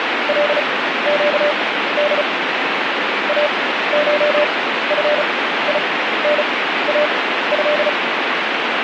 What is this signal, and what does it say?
Morse code (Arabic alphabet), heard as a keyed tone, machine-sent, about 35 wpm, spaced as for 15 wpm, 590 Hz, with radio static. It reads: لقد اشفيناه